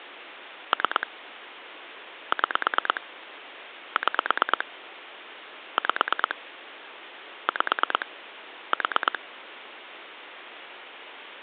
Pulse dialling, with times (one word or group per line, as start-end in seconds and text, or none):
0.7-1.1 3
2.3-3.0 6
4.0-4.7 6
5.8-6.4 5
7.5-8.1 5
8.7-9.2 4